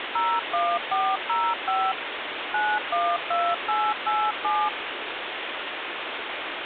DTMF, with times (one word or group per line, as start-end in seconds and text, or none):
0.2-1.9 01405
2.5-4.7 912887